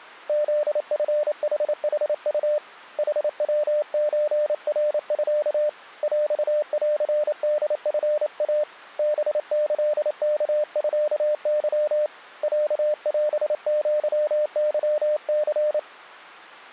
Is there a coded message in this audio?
Yes: Morse code (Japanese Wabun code) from 0.2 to 15.9 s, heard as a keyed tone, hand-sent with a paddle, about 28 wpm, 600 Hz. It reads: フチヌヌウ ヌヤソナミ ヰンホチイ ハキワミケ ロオアケニ